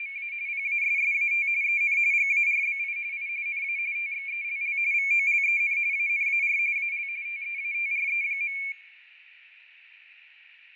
RTTY (45.45 baud, 170 Hz shift), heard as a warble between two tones, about 2300 Hz centre, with radio static and fading. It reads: … PASSAT EN GARBI I NA TXELL VOLEN ANAR AL TEATRE.